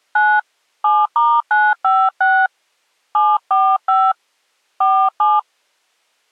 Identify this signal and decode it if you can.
DTMF, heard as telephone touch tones, dialled by hand, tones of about 240 ms. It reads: 9 7*956 745 47